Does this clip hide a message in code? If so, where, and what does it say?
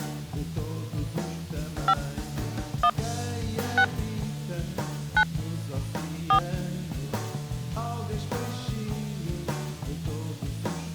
Yes: DTMF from 1.9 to 6.4 s, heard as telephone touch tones, dialled by hand, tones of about 80 ms. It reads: 5 1 6 9 4